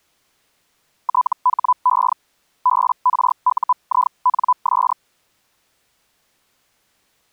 Hellschreiber (Feld-Hell, 122.5 baud), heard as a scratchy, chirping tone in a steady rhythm, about 1000 Hz. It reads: THE BRUINS